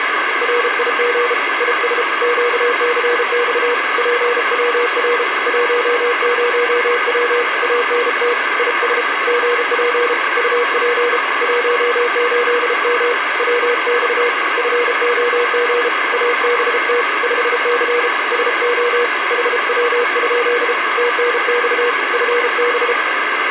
Morse code, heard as a keyed tone, hand-sent with a paddle, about 33 wpm, 480 Hz, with radio static. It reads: RIG IS QCX PWR 10W ANT IS GP UP 18M WX FOG ABT 5C SO HW? TNX FB